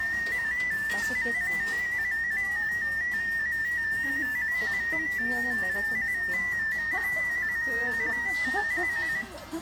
Multi-tone FSK (Olivia or MFSK type), about 250 Hz wide, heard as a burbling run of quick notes, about 15.625 baud, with room echo and the noise of a restaurant.